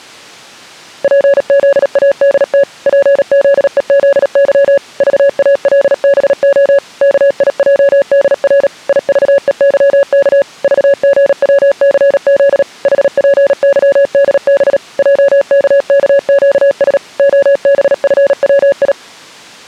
Morse code, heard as a keyed tone, machine-sent, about 37 wpm, 560 Hz. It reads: PZADT PZEZY VALBO KIJDR IVEYK VGWCZ HPYDB JKKQS OBFWI